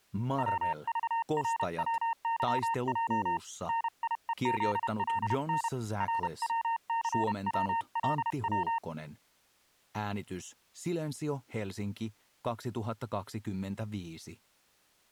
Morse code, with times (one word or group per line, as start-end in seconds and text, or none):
0.4-3.4 WVRWYJ
3.7-5.7 NIEZLN
6.0-8.8 RWCWLW